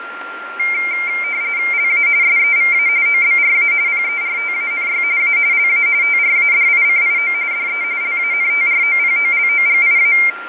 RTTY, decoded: LA SEVA OBRA PERTANY A LA TRADICIO DE LANTROPOLOGIA

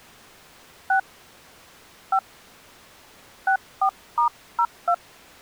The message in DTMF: 6 5 64*02

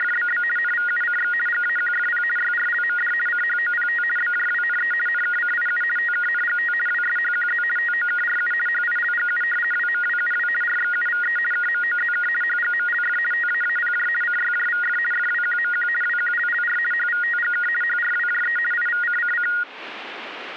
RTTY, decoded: … NVUCX GAQFP YRLMD CHOPT BJWNE NKCIU TKNGT WSHQZ TOKRU HILGU WMWUW RXUVE KMOZK HGMLF TAAPJ CYJVF FWQMQ WQLLR HVTGK HRWJE IVCCC

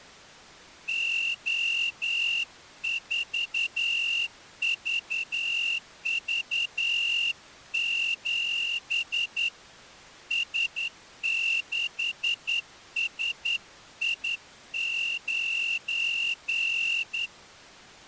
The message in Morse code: O4VV7 S6SI9

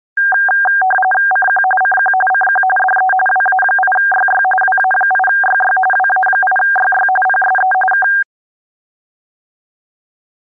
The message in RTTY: CQ CQ CQ DE WA8YY WA8YY WA8YY PSE K

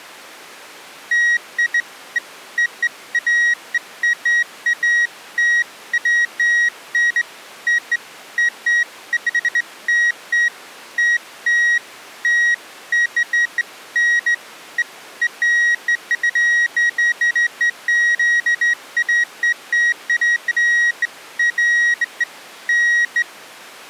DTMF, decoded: none

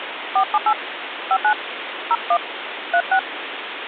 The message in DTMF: 478 59 01 36

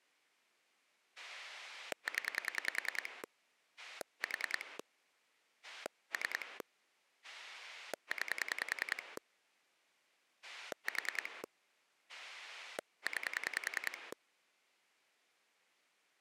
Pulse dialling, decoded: 0 4 3 9 4 9

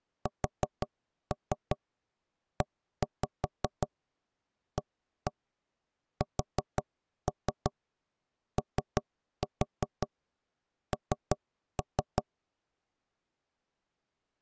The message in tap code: SEASON

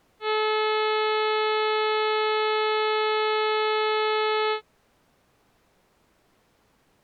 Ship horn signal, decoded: 1 long

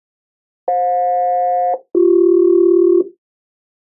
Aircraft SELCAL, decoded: FJ-BC

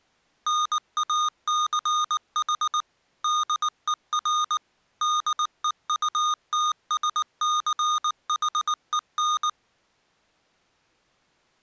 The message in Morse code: NACH DER DEUTSCHEN

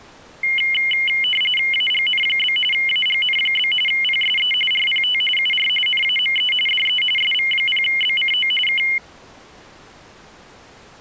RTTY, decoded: AGN? AGN? PSE RPT UR NAME DE SV0BCO K

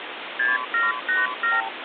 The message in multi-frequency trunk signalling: 6787

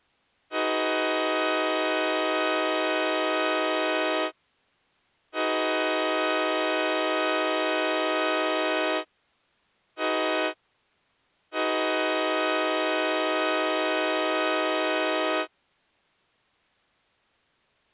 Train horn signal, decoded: 2 long, 1 short, 1 long

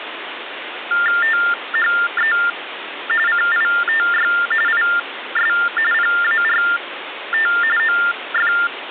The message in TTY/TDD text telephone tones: THE CITY IS PART OF

